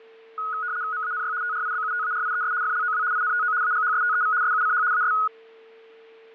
RTTY (75 baud, 170 Hz shift), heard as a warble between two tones, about 1360 Hz centre, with a steady whistle near 450 Hz. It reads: MANY TRIBUTARIES FLOW INTO AGHSTEV SUCH AS